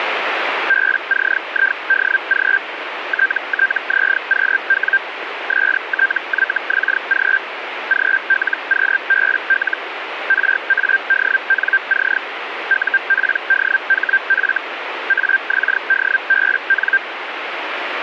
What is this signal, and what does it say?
Hellschreiber (Feld-Hell, 122.5 baud), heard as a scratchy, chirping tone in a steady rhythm, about 1600 Hz, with radio static. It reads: BCIDG TTZQW STYXG GLQBL RADNC UPDHF AXDBN